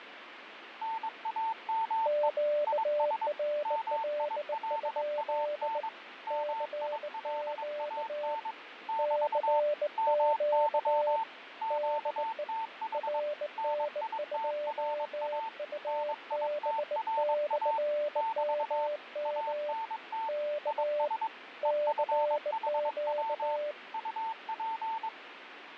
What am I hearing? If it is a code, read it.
Morse code, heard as two keyed tones, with radio static and fading. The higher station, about 22 wpm, 900 Hz: NAME IS MILAN MILAN <BT> MY QTH NITRA NITRA <BT> ANT IS EFHW UP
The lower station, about 19 wpm, 590 Hz: QRL? CQ CQ DE RN2UB/MM K CQ